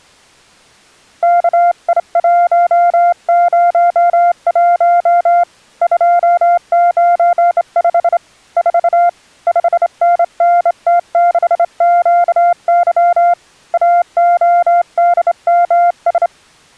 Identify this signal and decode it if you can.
Morse code, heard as a keyed tone, hand-sent with a straight key, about 27 wpm, 700 Hz. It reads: KI101 295 4 5NNT6QY AODMS